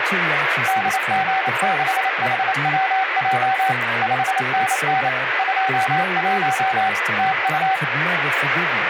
Morse code, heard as a keyed tone, machine-sent, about 28 wpm, 760 Hz, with radio static and speech in English. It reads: DG6HWJ 5NN 21 TU